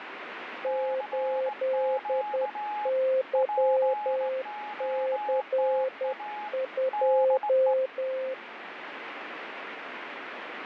Morse code, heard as two keyed tones, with radio static. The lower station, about 10 wpm, 520 Hz: 8YC2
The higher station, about 18 wpm, 840 Hz: CQ POTA DE